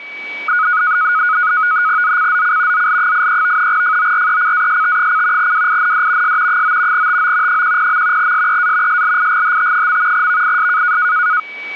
NAVTEX (SITOR-B), 100 baud, 170 Hz shift, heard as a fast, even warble, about 1360 Hz centre, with a steady whistle near 2280 Hz. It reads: ZCZC ZL83 FORECAST: WIND S 9 TO 10. SEA SLIGHT. VIS